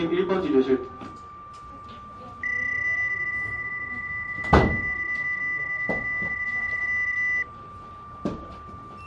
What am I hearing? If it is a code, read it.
PSK31 (31.25 baud), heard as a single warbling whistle, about 2000 Hz, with fading, a steady whistle near 1180 Hz and the noise of a crowd indoors.